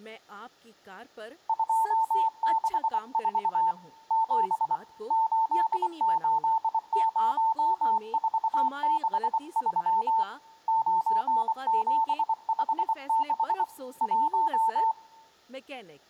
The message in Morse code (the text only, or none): 264 7 880463 9756 1